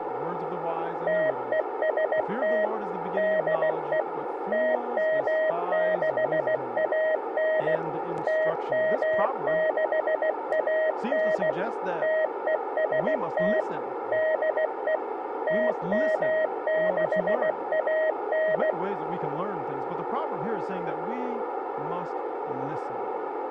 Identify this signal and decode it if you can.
Morse code, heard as a keyed tone, machine-sent, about 16 wpm, 630 Hz. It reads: TEST DE TM6AN TM6AN TEST DE TM6AN